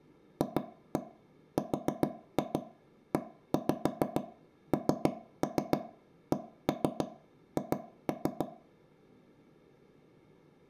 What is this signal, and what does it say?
Tap code, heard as taps on a table, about 6 knocks a second, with room echo. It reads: FRENCH